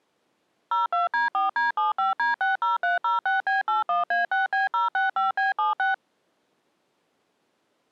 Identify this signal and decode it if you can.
DTMF, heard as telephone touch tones, dialled by machine, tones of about 150 ms. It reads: 02D4D75D60306B81A6B065B76